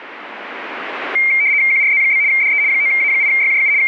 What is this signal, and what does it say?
RTTY (75 baud, 170 Hz shift), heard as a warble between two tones, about 2200 Hz centre. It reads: QRZ? DE 9A8YJU …